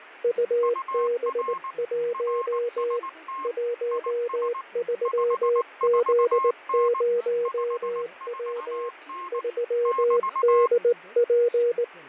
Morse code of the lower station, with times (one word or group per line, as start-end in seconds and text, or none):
0.2-3.0 UB1
3.4-8.9 13Z0W
9.3-11.8 3DP